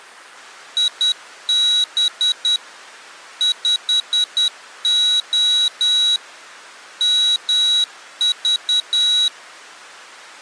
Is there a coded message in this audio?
Yes: Morse code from 0.7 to 9.3 s, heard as a high beeper, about 10 wpm, 3900 Hz. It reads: IB 5O MV